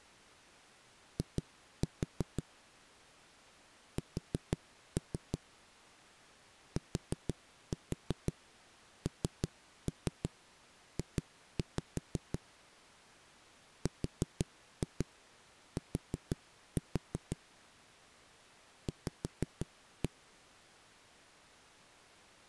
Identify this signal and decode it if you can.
Tap code, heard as knocks on a wall, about 5 knocks a second. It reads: I S TNJ RT V